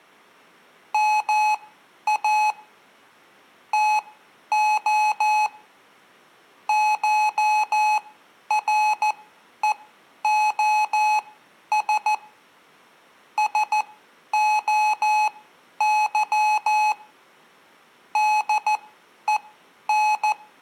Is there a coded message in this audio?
Yes: Morse code (Greek alphabet) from 0.9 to 20.4 s, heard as electronic beeps, machine-sent, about 14 wpm, spaced as for 10 wpm, 850 Hz, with room echo. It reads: ΜΑ ΤΟ ΧΡΕΟΣ ΣΟΥ ΔΕΝ